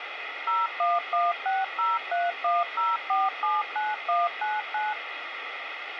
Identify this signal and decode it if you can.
DTMF, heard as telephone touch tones, dialled by machine, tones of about 190 ms, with radio hiss. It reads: 01160310479199